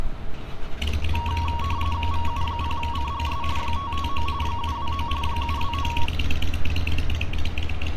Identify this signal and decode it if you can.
RTTY (45.45 baud, 170 Hz shift), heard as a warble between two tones, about 1020 Hz centre, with street noise. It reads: VU0CGS 559 729 729